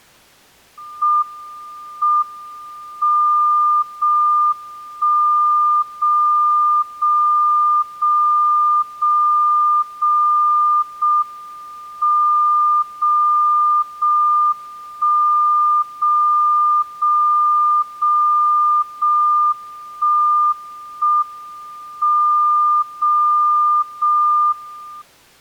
Radio time signal (JJY), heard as a tone whose level steps once a second, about 1200 Hz. The time is 23:20 Japan time. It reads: M M 0 1 0 0 0 0 0 0 M 0 0 1 0 0 0 0 1 1 M 0 0 1